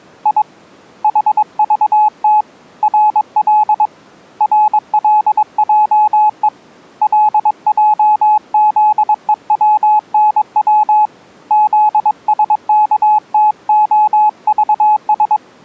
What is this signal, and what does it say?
Morse code, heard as a keyed tone, hand-sent with a paddle, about 22 wpm, 850 Hz. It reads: I HVT RL RLJE LJZEWNW ZSKTOVS